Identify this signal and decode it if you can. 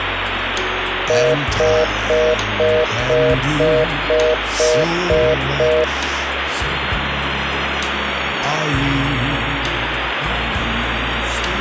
Telephone call progress tone (North American plan), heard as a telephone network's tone, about 480, 620 Hz, 0.25 s on and 0.25 s off, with phone line noise. Congestion tone.